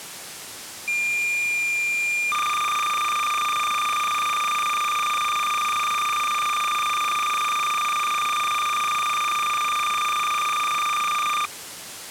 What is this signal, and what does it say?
Cassette data (Kansas City type), 300 baud, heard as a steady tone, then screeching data.